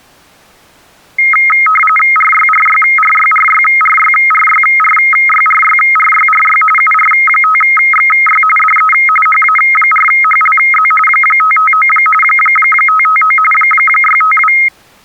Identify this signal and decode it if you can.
RTTY (45.45 baud, 850 Hz shift), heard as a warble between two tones, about 1700 Hz centre. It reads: RYRYRYRYRYRYRYRYRYRY UR5XY DE HA4HLZ 559 559 652